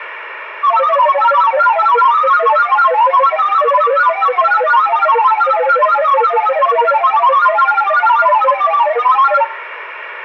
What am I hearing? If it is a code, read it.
Multi-tone FSK (Olivia or MFSK type), about 1000 Hz wide, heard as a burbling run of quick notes, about 31.25 baud, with radio static and room echo.